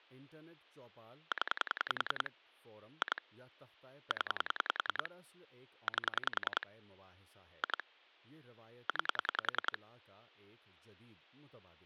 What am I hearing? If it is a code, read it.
Pulse dialling, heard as clicks on a phone line, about 10 pulses a second, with speech in Urdu. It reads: 0 2 0 8 2 9